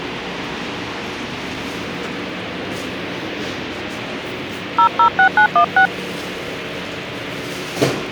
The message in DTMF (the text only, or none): 006916